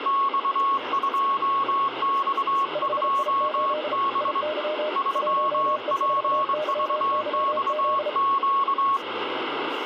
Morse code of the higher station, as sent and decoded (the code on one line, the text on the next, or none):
-..- ..--- -..- ..--- -... / ...-- .--. ...- -..- --.-
X2X2B 3PVXQ